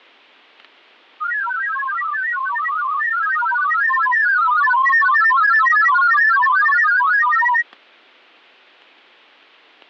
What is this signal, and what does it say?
Multi-tone FSK (Olivia or MFSK type), about 1000 Hz wide, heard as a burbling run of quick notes, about 31.25 baud, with fading and static crashes.